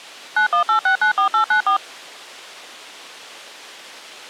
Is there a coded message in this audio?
Yes: DTMF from 0.4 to 1.8 s, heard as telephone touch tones, dialled by machine, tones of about 100 ms. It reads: 918694894